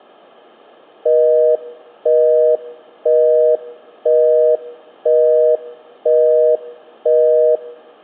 Telephone call progress tone (North American plan), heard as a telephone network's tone, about 480, 620 Hz, 0.5 s on and 0.5 s off. Busy tone.